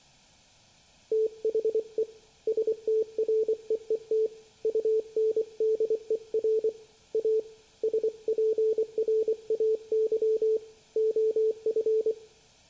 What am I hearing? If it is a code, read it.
Morse code, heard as a keyed tone, hand-sent with a paddle, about 24 wpm, 440 Hz, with room echo. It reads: THE STREET UNDER A SPRAY OF